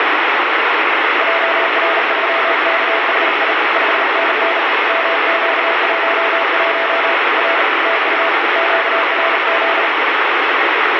Morse code, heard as a keyed tone, hand-sent with a bug key, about 38 wpm, 670 Hz, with heavy radio static. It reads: JR3KHI 5NN MQ11 R TU QRZ